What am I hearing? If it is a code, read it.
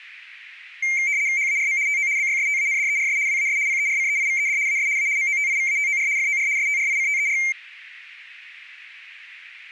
RTTY (75 baud, 170 Hz shift), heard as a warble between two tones, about 2200 Hz centre. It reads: HARM TO BYSTANDERS WAS PERCEIVED AS A MOTIVATOR FOR STRICTER